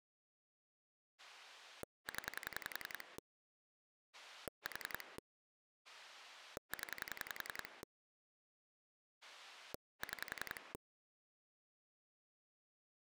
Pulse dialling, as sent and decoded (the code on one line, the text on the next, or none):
10 / 4 / 10 / 6
0 4 0 6